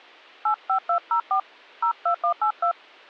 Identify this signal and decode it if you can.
DTMF, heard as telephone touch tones, dialled by hand, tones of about 90 ms. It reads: 85204 02182